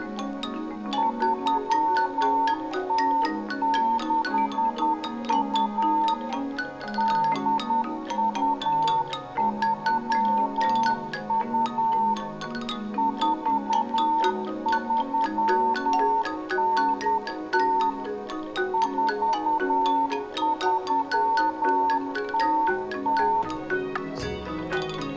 Morse code (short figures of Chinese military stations), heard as a keyed tone, machine-sent, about 10 wpm, 900 Hz, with room echo. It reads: 3062 8232 4390 4300